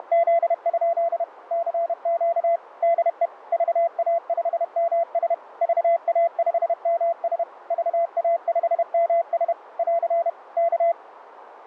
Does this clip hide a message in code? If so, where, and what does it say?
Yes: Morse code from 0.0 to 11.0 s, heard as a keyed tone, machine-sent, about 31 wpm, 680 Hz, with radio static. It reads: … CQ DE VA5MS VA5MS VA5MS <AR> K